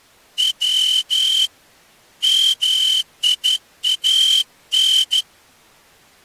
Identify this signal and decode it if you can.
Morse code (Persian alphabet), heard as a whistle, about 12 wpm. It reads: و میان